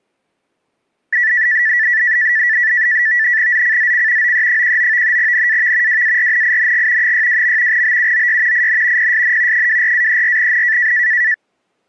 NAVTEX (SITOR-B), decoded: ZCZC OE19 NAV WARNING 62. BUOY IN PSN 24-34N

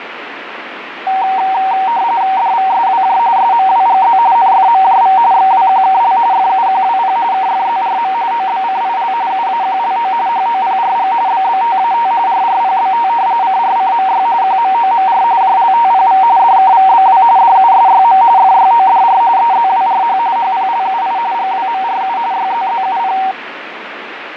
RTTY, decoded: DVSWJ SMWGZ NFMJV XWQKL FUQWP KFZRM OBCIL UAQLO HOPRG BBTAT RRPBT CRCMY QMOMR JLTPV DKVBW DUSYM FYODR EZWRH HPLUI GWMRU YZZUP

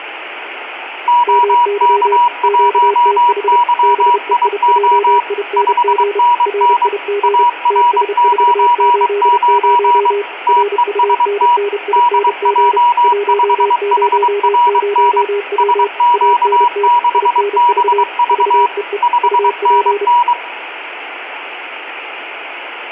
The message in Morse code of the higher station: OK1YIO 5NN AR99 TEST DJ5HRN SQ6BV 5NN

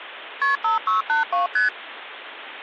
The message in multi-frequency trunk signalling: KP 5682 ST

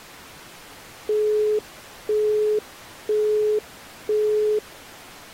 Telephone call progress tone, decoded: busy tone

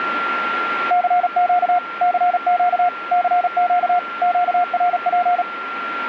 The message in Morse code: CQ CQ CQ QRP

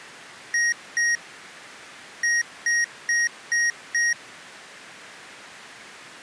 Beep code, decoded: 2-5

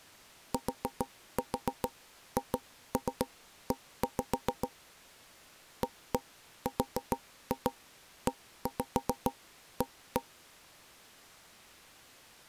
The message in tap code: THE AREA

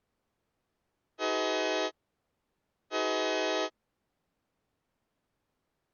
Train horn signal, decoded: 2 short

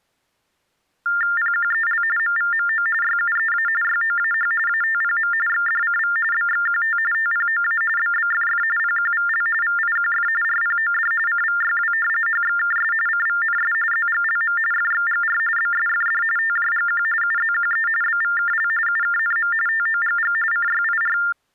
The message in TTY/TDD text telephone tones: PQEL MVMO YUEA YOAH ATPM XDCV BXQT TPOA BBFF PQVL VIQF RPOD CVYW HXKS CVNS ZGLM FXGR BSFD TJGQ UZQE BVKL UKNM TOGG CYIR

